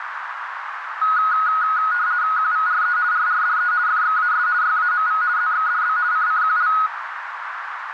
RTTY (50 baud, 170 Hz shift), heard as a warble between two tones, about 1360 Hz centre, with radio static and a narrow filter. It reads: QVRE RRDE FXAS YAMV ZXDB CCQL